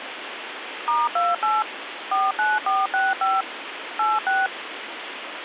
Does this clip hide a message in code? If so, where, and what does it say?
Yes: DTMF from 0.9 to 4.5 s, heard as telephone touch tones, dialled by machine, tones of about 200 ms, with phone line noise. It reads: *28 49465 86